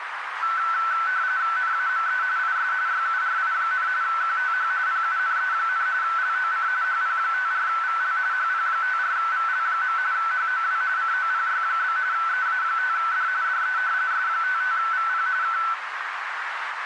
RTTY (45.45 baud, 170 Hz shift), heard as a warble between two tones, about 1420 Hz centre, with radio static and a narrow filter. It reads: NAME IS YURI, QTH PUNE, LOC HP54VL HP54VL. HOW COPY? EA5D DE S55VP K